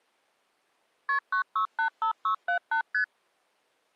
Multi-frequency trunk signalling (R1, as on North American trunks), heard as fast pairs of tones, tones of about 100 ms. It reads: KP 9685678 ST